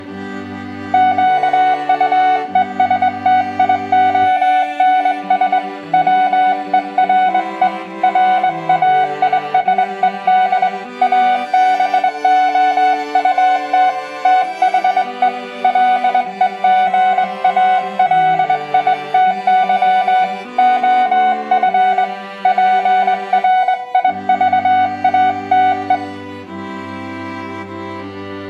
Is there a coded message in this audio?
Yes: Morse code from 0.9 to 26.0 s, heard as a keyed tone, hand-sent with a straight key, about 21 wpm, 740 Hz, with room echo. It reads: QUESTIONS WERE RAISED ABOUT THE LEGALITY OF PRIVATE